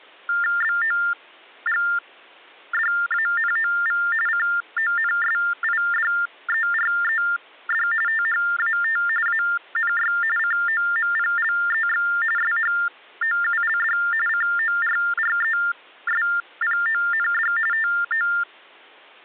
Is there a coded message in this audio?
Yes: TTY/TDD text telephone tones (45.45 baud Baudot) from 0.3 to 18.4 s, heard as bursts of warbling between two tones, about 400 Hz shift, 1600 Hz centre. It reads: BOGDANOV CONSIDERED THAT ANY COMPLEX SHOULD CORRESPOND TO